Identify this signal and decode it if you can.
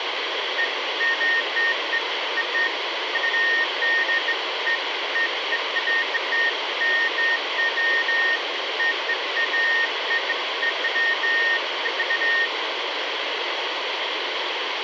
Beeps of irregular length, with radio hiss. There is no code.